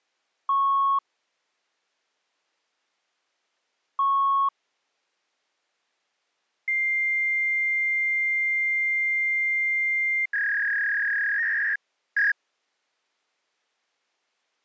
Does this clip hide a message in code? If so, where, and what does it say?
Yes: fax machine handshake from 0.5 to 12.3 s, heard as beeps, a long tone and a warble.